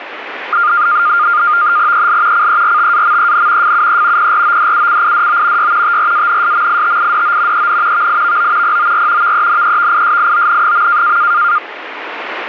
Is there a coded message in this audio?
Yes: NAVTEX (SITOR-B), 100 baud, 170 Hz shift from 0.5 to 11.6 s, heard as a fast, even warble, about 1310 Hz centre, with radio static. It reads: EL CERTAMEN FUE PRODUCIDO Y TRANSMITIDO EN VIVO POR VENEVISION.